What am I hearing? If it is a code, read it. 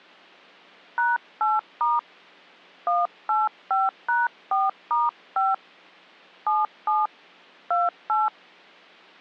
DTMF, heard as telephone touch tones, dialled by hand, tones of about 180 ms. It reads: #8* 185#4*5 77 28